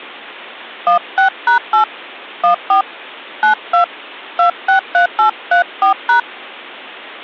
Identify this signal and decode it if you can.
DTMF, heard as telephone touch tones, dialled by hand, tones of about 110 ms. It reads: 16#8 14 92 263834#